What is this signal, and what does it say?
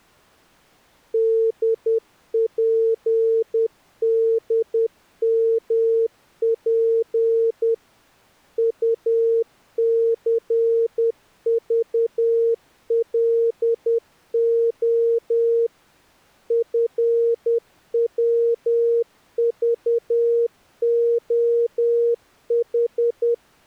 Morse code, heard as a keyed tone, machine-sent, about 10 wpm, 460 Hz. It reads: DPDMP UCVLO FWVOH